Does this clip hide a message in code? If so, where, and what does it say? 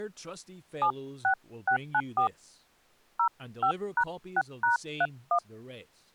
Yes: DTMF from 0.8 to 5.4 s, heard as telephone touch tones, dialled by hand, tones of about 90 ms, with speech in English. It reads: 76694 05#6#31